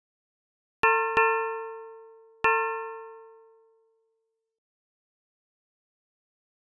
Ship's bell, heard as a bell. 3. Three half-hours of the watch have passed.